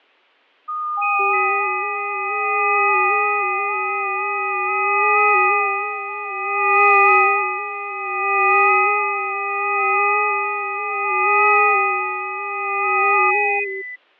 FT8 (several signals at once), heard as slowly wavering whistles, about 6.25 baud, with fading.